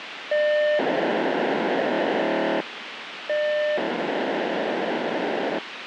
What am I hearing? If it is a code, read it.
POCSAG pager data (1200 baud), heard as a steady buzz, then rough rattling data, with radio hiss.